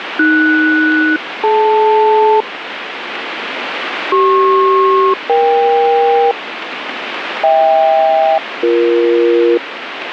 Aircraft SELCAL, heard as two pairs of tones, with radio static. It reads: AS-DL CP-EK HK-BE